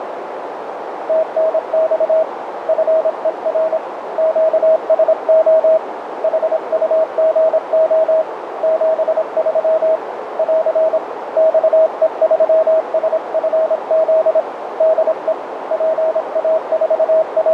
Morse code, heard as a keyed tone, hand-sent with a paddle, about 26 wpm, 640 Hz, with radio static and a narrow filter. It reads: TNX FER QSO HUGO 73 <AR> XE3SFZ DE …